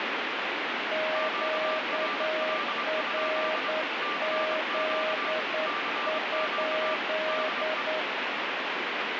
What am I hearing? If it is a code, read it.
Morse code, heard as two keyed tones, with heavy radio static. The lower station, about 9 wpm, 630 Hz: QRZ?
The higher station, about 25 wpm, 1180 Hz: QRL? CQ CQ DE